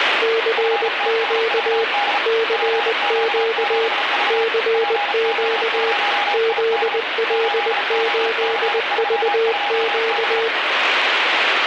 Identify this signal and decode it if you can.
Morse code, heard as two keyed tones, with radio static. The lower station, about 20 wpm, 450 Hz: CQ CQ CQ ZL8VQ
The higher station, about 35 wpm, 820 Hz: FTSVD PQ7V PO0ID 8OC32B